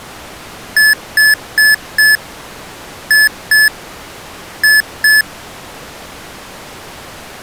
Beep code, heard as beeps from a small speaker, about 1750 Hz. 4-2-2. In Phoenix BIOS tables: shutdown test failure.